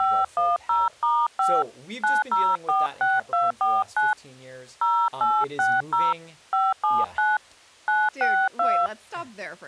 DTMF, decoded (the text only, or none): 510*5 9046249 0860 579 962